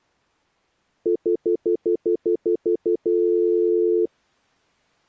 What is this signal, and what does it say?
Telephone call progress tone (North American plan), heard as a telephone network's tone, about 350, 440 Hz, 0.1 s on and 0.1 s off. Stutter dial tone.